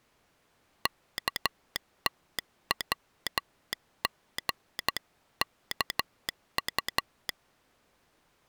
Morse code (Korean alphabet), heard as a telegraph sounder, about 12 wpm. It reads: 없이